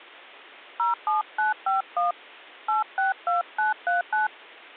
DTMF, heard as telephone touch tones, dialled by hand, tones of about 140 ms. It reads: 07951 862939